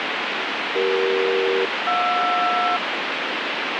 Aircraft SELCAL, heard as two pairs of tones, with heavy radio static. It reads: CE-JR